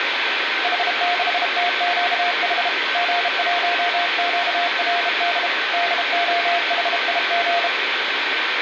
Morse code, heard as a keyed tone, hand-sent with a bug key, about 32 wpm, 700 Hz, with radio static and room echo. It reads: H6TQH G1QRD DOHIG